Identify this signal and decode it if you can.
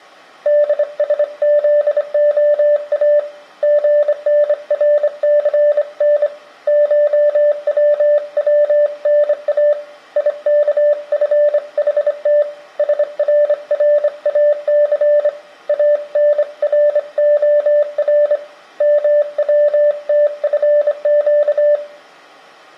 Morse code (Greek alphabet), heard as a keyed tone, hand-sent with a straight key, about 25 wpm, 590 Hz. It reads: ΔΣΖΟΑ ΓΝΡΘΝ ΧΩΩΝΑ ΙΚΦΗΤ ΣΡΡΑΘ ΑΝΡΟΡ ΜΩΤΦΨ